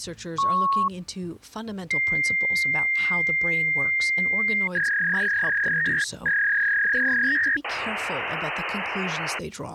Fax machine handshake, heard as a beep, a long tone, a warble and hiss, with speech in English.